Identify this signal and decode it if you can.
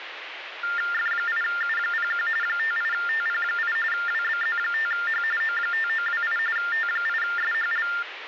TTY/TDD text telephone tones (45.45 baud Baudot), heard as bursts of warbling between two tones, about 400 Hz shift, 1600 Hz centre, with phone line noise. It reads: F8U01 58TP8 WBZ5H O5928 T8SHL